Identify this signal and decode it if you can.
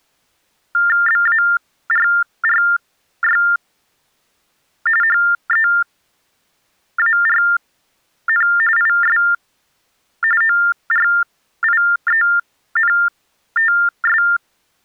TTY/TDD text telephone tones (45.45 baud Baudot), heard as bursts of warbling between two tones, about 400 Hz shift, 1600 Hz centre. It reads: BARRY HEARN IS ORIENTS